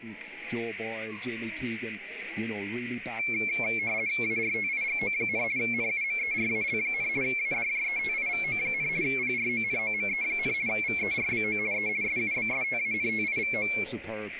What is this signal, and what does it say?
RTTY (50 baud, 170 Hz shift), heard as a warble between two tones, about 2250 Hz centre, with static crashes. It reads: ARTIGO, NUMERAL, ADJETIVO, PRONOME, VERBO E SUBSTANTIVO